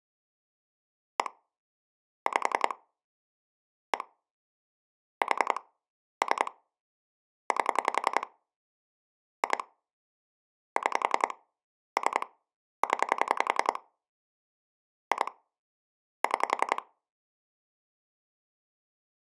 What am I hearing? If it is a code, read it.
Pulse dialling, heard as clicks on a phone line, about 10 pulses a second. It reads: 1 5 1 4 3 8 2 6 3 0 2 6